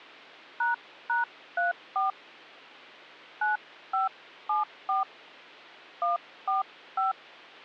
DTMF, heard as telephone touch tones, dialled by hand, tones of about 140 ms. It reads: ##34 9574 145